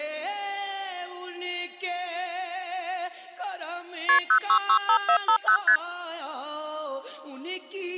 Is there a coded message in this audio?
Yes: multi-frequency trunk signalling (R1, as on North American trunks) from 4.1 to 5.8 s, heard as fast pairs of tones, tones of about 80 ms. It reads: KP 0665450 ST